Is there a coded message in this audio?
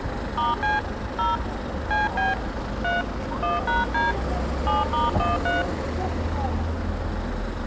Yes: DTMF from 0.4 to 5.6 s, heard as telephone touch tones, dialled by hand, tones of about 170 ms, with street noise. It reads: *C 0 CB 3 1#D 7*13